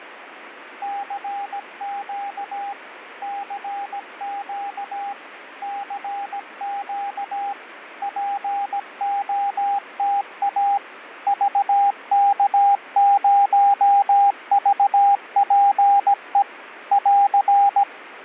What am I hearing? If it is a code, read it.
Morse code, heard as a keyed tone, machine-sent, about 17 wpm, 800 Hz, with radio static and fading. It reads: CQ CQ CQ POTA VK0VPE <AR>